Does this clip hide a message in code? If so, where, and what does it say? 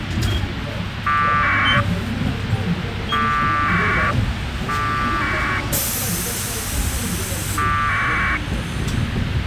Yes: packet radio (AX.25, as in APRS), 1200 baud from 1.1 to 8.4 s, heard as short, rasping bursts, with radio hiss and the noise inside a bus.